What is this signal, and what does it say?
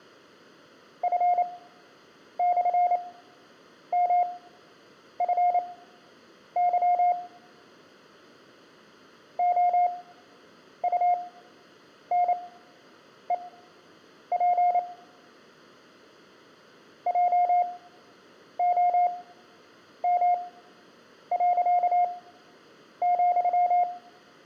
Morse code, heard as a keyed tone, machine-sent, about 28 wpm, spaced as for 8 wpm, 710 Hz, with room echo. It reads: F/MFY OUNEP JOM.,